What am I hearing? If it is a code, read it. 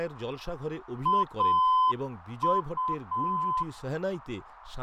Morse code, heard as a keyed tone, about 7 wpm, 1020 Hz, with radio static, fading and speech in Bangla. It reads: AU